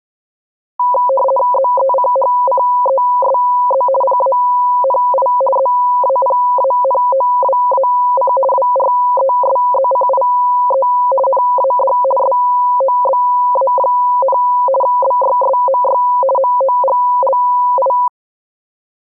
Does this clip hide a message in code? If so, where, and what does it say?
Yes: RTTY (50 baud, 450 Hz shift) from 0.8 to 18.1 s, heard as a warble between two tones, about 760 Hz centre. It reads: ZECHCESZ PANI ZAPANOWAC WRESZCIE NAD SOBA, BYSMY MOGLI